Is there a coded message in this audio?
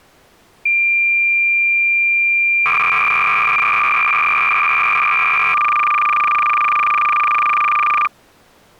Yes: cassette data (Kansas City type), 300 baud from 0.7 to 8.1 s, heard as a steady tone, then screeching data.